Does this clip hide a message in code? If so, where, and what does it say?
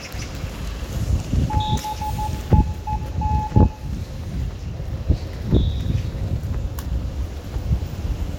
Yes: Morse code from 1.4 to 3.7 s, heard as a keyed tone, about 14 wpm, 860 Hz, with room echo and the noise of a residential street. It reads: BEEN